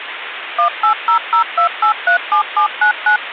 DTMF, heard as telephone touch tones, dialled by machine, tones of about 100 ms, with phone line noise. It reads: 18002837799